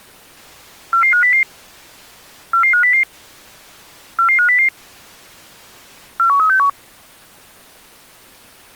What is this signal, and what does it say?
Five-tone selective call (CCIR), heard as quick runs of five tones, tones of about 100 ms. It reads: 44500 44500 44500 41361